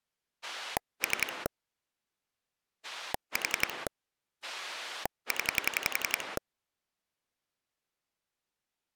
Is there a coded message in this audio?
Yes: pulse dialling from 0.4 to 6.4 s, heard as a rotary dial, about 11 pulses a second. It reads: 3 4 0